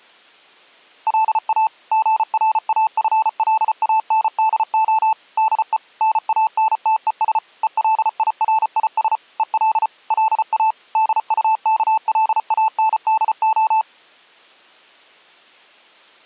Morse code, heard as a keyed tone, machine-sent, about 34 wpm, 880 Hz. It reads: LA GRAFLANDO DE NANTES ELIRIS EL LA DUKLANDO